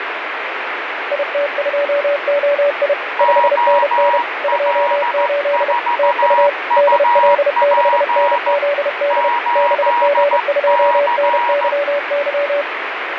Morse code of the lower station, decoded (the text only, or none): IT2OI 5NN 28 TU DL6NZD BG2NYY